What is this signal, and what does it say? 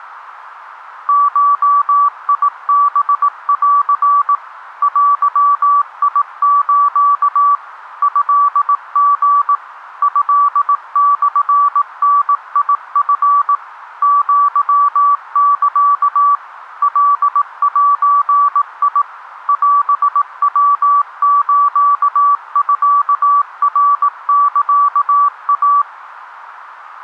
Morse code (Japanese Wabun code), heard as a keyed tone, machine-sent, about 18 wpm, 1150 Hz, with radio static. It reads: ゴハン デス トリ トモダチ アサ カゼ オヤスミナサイ